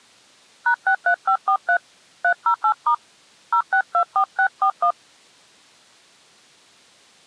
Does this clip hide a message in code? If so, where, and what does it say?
Yes: DTMF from 0.7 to 4.9 s, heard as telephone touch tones, dialled by hand, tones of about 80 ms. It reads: #63543 308* 0624641